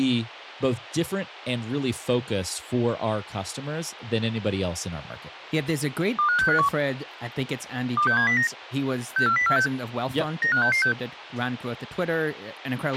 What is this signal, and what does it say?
Five-tone selective call (CCIR), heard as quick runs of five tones, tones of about 100 ms, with a squelch burst at the end and speech in English. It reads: 25651 26709 64046 95666